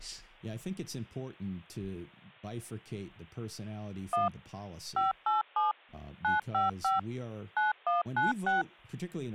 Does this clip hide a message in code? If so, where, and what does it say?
Yes: DTMF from 4.1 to 8.6 s, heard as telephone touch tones, dialled by machine, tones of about 150 ms, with speech in English. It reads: 1 587 955 9196